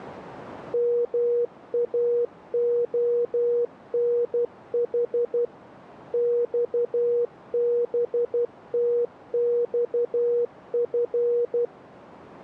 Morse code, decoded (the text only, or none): MAONH XBTXF